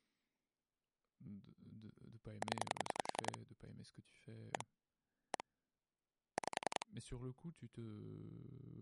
Pulse dialling, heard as clicks on a phone line, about 10 pulses a second, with speech in French. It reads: 0 1 1 5